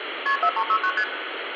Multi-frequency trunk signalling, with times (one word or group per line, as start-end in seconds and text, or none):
0.3-0.4 KP
0.4-0.9 4369
1.0-1.0 ST